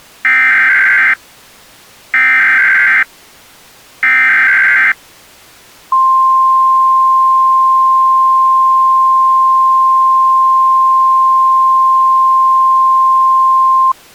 Emergency Alert System (SAME) tones (header bursts, then the 1050 Hz attention tone), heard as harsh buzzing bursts, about 520.83 baud.